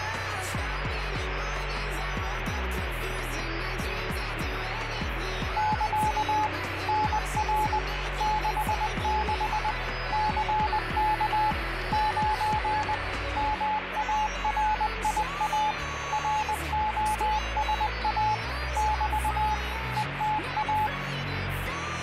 Morse code, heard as a keyed tone, machine-sent, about 20 wpm, 860 Hz, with radio static. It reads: <KA> NR 66 CK 9 MARIA ROSA <BT> ETA